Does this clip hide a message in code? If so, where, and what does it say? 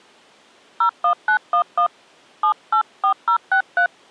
Yes: DTMF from 0.8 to 3.9 s, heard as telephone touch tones, dialled by hand, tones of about 90 ms. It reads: 01911 784063